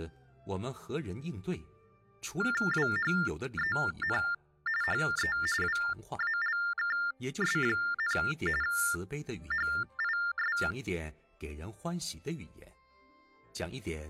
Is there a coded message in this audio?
Yes: TTY/TDD text telephone tones (45.45 baud Baudot) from 2.4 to 10.7 s, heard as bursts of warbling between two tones, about 400 Hz shift, 1600 Hz centre. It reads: WHEN HE WALKS, HIS